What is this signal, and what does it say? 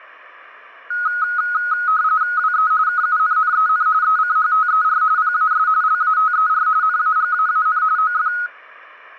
RTTY (45.45 baud, 170 Hz shift), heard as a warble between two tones, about 1360 Hz centre. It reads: WE KUNNEN ECHTER PAS LATER NAGAAN OF